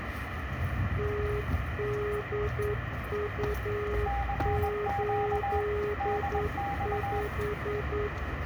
Morse code, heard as two keyed tones, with radio static and street noise. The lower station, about 9 wpm, 420 Hz: TDU85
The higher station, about 21 wpm, 800 Hz: CQ DX